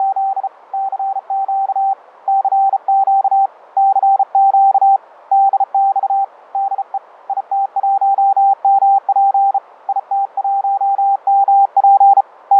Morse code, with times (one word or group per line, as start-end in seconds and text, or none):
0.0-0.5 …
0.7-1.9 CQ
2.3-3.5 CQ
3.8-5.0 CQ
5.3-6.2 DX
6.5-7.0 DE
7.3-9.6 IT1MP
9.9-12.2 IT1MP
12.5-12.6 …